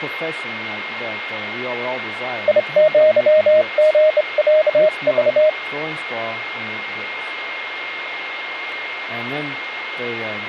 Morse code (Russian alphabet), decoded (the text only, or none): ИЪГЯЖ